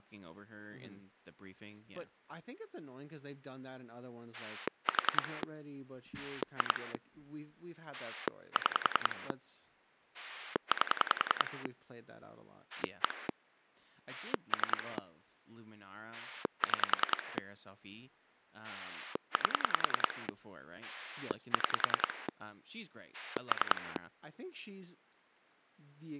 Pulse dialling, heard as a rotary dial, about 10 pulses a second, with speech in English. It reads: 4 2 6 8 1 3 6 8 6 3